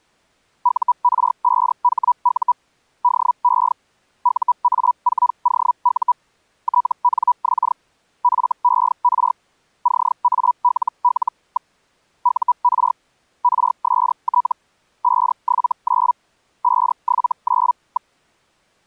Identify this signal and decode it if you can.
Hellschreiber (Feld-Hell, 122.5 baud), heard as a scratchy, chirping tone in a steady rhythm, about 980 Hz. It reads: UR5HU DE UA4OU TNX FER CALL. UR RST 579 579.